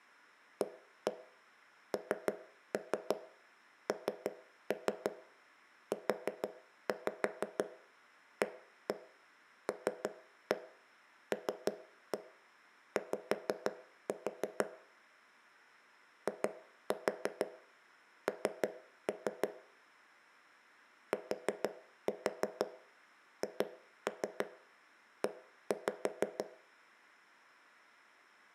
Tap code, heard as knocks on wood, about 6 knocks a second, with room echo. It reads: ANNUALLY IN THE